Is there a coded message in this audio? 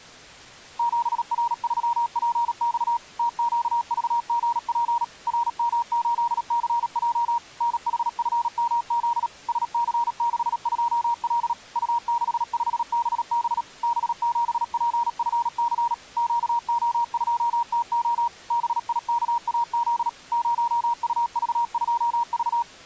Yes: Morse code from 0.7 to 22.7 s, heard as a keyed tone, machine-sent, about 37 wpm, 940 Hz. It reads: 7R3PX TQVGP RM8CJ NHFMZ SC62L U65BB B7PFC QO2TO BIKAZ 0UV2V